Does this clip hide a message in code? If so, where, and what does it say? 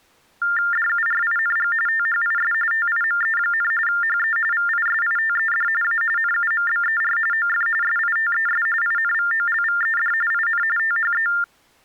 Yes: TTY/TDD text telephone tones (45.45 baud Baudot) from 0.4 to 11.4 s, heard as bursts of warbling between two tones, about 400 Hz shift, 1600 Hz centre. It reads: DURING THIS TIME, HE VISITED A NUMBER OF SITES INVOLVED IN THE